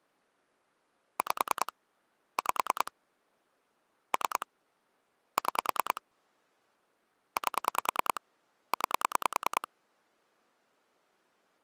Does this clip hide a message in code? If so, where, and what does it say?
Yes: pulse dialling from 1.2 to 9.7 s, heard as clicks on a phone line, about 10 pulses a second. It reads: 5 5 3 6 8 9